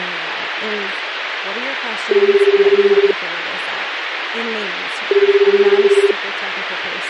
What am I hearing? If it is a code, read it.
Telephone call progress tone (Japanese plan), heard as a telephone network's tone, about 380, 400, 420 Hz, 1 s on and 2 s off, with phone line noise and speech in English. Ringback tone.